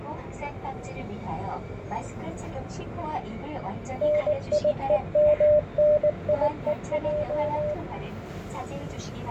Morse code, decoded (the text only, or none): NIEMNIEJ